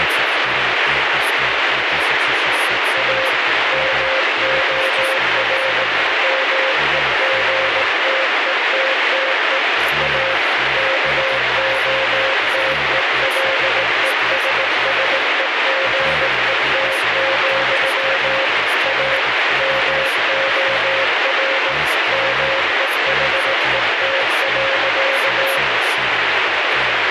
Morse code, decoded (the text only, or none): A MOR MEGTETTE A KOTELESSEGET, A MOR MEHET.